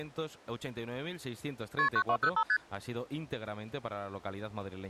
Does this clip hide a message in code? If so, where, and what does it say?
Yes: multi-frequency trunk signalling (R1, as on North American trunks) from 1.8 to 2.6 s, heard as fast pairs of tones, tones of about 70 ms. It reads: KP 9205 ST